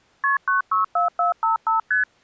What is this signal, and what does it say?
Multi-frequency trunk signalling (R1, as on North American trunks), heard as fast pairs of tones, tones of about 130 ms. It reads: KP 964455 ST